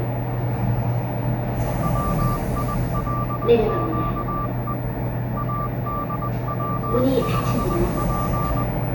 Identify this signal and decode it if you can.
Morse code, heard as a keyed tone, hand-sent with a paddle, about 20 wpm, 1180 Hz, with the noise inside a lift. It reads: WILQE ADW5P